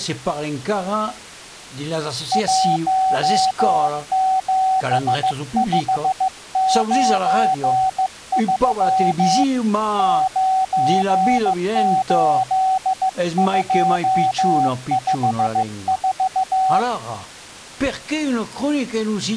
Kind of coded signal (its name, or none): Morse code